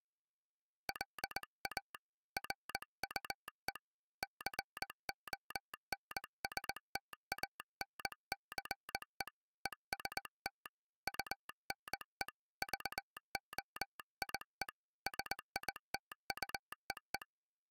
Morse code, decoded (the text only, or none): LA RUE CONSTANCE EST UNE VOIE SITUEE